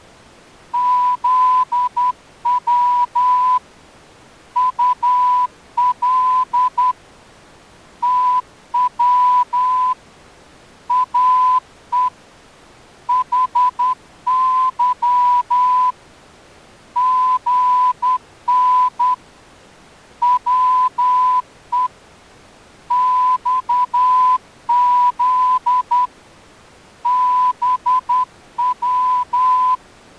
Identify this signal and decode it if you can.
Morse code, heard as a whistle, hand-sent with a straight key, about 10 wpm. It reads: ZW UL TW AE HY GN WE XZ BW